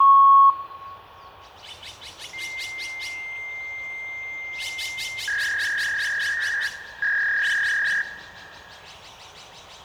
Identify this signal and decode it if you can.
Fax machine handshake, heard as a beep, a long tone and a warble, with room echo and the noise of a park.